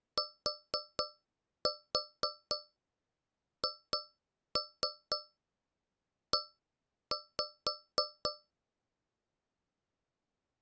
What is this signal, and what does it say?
Tap code, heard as taps on a metal pipe, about 4 knocks a second. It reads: THE